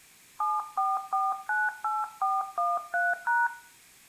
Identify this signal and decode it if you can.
DTMF, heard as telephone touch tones, dialled by hand, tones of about 200 ms, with room echo. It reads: 74498413#